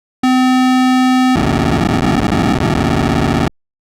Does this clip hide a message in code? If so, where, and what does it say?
Yes: POCSAG pager data (512 baud) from 0.2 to 3.5 s, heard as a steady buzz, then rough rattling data.